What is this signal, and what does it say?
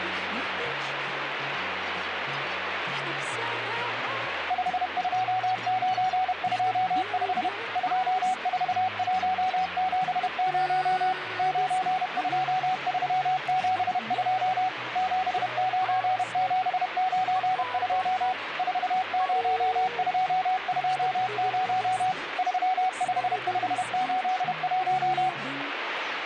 Morse code, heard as a keyed tone, machine-sent, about 31 wpm, 750 Hz, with radio static. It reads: 52925 24170 92372 79792 40220 35581